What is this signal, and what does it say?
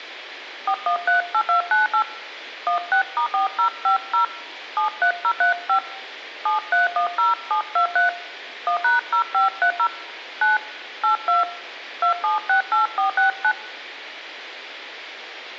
DTMF, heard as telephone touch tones, dialled by hand, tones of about 110 ms. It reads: 4138298 16*4050 73035 7310723 1#0530 9 82 2768469